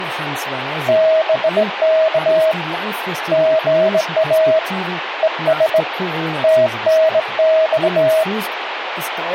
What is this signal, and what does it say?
Morse code, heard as a keyed tone, hand-sent with a straight key, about 18 wpm, 640 Hz, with radio static and speech in German. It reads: BK GA ES TNX